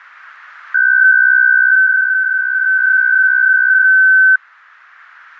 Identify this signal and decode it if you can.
PSK63 (62.5 baud), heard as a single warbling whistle, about 1550 Hz.